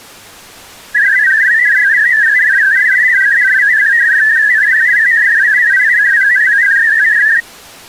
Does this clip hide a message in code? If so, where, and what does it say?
Yes: multi-tone FSK (Olivia or MFSK type), about 500 Hz wide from 0.9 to 7.4 s, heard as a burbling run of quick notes, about 62.5 baud.